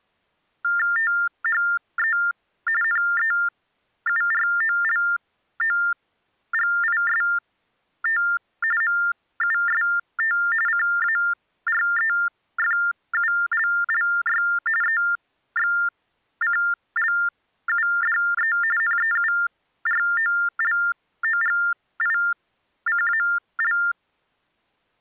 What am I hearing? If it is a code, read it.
TTY/TDD text telephone tones (45.45 baud Baudot), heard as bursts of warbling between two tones, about 400 Hz shift, 1600 Hz centre. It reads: THE NEUROLOGIST MUST CAREFULLY EXCLUDE NEUROLOGICAL